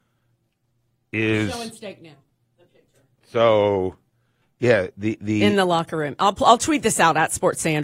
Speech in English. There is no code.